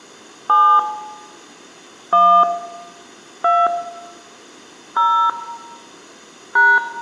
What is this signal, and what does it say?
DTMF, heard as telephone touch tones, dialled by hand, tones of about 280 ms, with room echo. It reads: 7 1 2 0 #